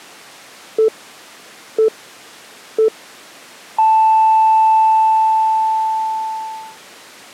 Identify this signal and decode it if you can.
Radio time signal (three low pips and a long one an octave up, as on NHK), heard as pips.